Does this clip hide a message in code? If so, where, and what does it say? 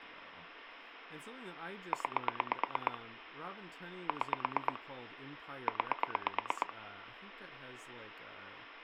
Yes: pulse dialling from 1.9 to 6.7 s, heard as clicks on a phone line, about 8 pulses a second, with phone line noise and speech in English. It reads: 9 6 9